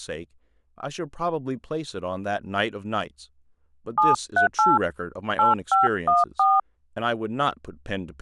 DTMF, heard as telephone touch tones, dialled by hand, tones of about 140 ms, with speech in English. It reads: 738 8514